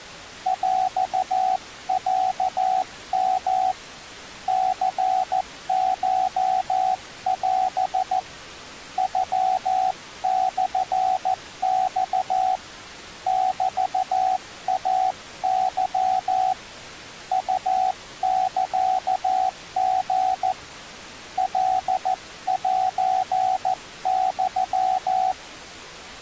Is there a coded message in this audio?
Yes: Morse code (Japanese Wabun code) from 0.4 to 25.4 s, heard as a keyed tone, hand-sent with a paddle, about 14 wpm, 750 Hz. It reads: ヰロヨ ニコオ ノモマ メイケ ウサリ カセユ